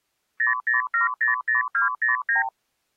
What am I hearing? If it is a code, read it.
Multi-frequency trunk signalling (R2, with the far end's replies), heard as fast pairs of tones, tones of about 140 ms. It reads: 00700209